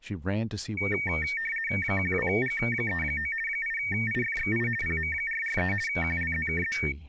RTTY (50 baud, 450 Hz shift), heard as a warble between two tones, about 2050 Hz centre, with speech in English. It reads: 12G39 8IFXI PM443 QLZKZ